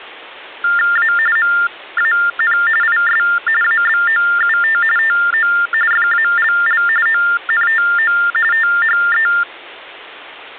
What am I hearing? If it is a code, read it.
TTY/TDD text telephone tones (45.45 baud Baudot), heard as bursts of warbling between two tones, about 400 Hz shift, 1600 Hz centre. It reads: A MAN IS ABOUT TO FALL ONTO THE